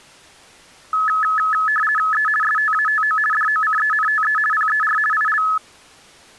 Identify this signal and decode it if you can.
RTTY (50 baud, 450 Hz shift), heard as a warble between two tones, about 1500 Hz centre. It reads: E STATO DOCENTE PER IL